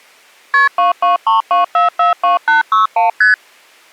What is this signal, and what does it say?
Multi-frequency trunk signalling (R1, as on North American trunks), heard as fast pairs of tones, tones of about 140 ms. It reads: KP 2232442861 ST